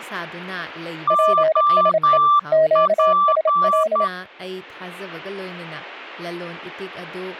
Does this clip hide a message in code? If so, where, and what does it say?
Yes: Morse code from 1.0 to 4.1 s, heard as two keyed tones, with speech in Manipuri. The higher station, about 10 wpm, 1170 Hz: OP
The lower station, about 28 wpm, 630 Hz: PSE QSL